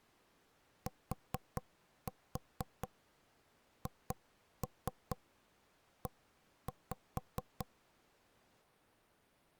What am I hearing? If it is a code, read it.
Tap code, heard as knocks on wood, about 4 knocks a second. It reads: THE